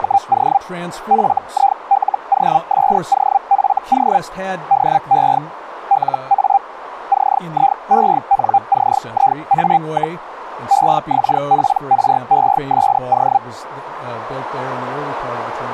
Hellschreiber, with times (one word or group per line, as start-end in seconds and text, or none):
0.0-0.6 …
1.1-4.2 FILOSOFO
4.7-5.4 DE
5.9-6.6 LA
7.1-10.2 CIENCIA,
10.7-13.4 EXPRESO